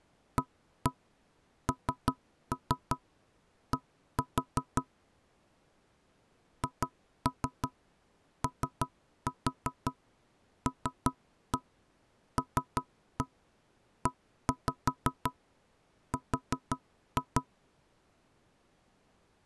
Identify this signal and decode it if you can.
Tap code, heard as knocks on wood, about 5 knocks a second. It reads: AND HOLLER